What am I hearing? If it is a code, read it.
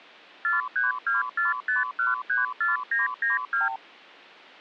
Multi-frequency trunk signalling (R2, with the far end's replies), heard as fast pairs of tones, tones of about 150 ms. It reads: 43245134992